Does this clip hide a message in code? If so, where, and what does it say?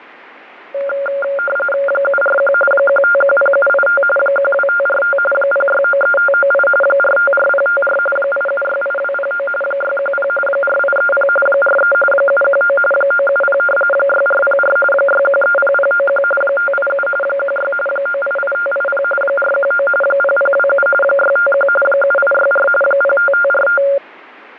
Yes: RTTY (45.45 baud, 850 Hz shift) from 0.7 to 24.0 s, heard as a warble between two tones, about 980 Hz centre, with radio static and static crashes. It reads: 741 1510785 12545 0693598 454054 8768209 610 4830 43 719 970 6404 6130091 587 16 988580 419 0027 651 7864 05545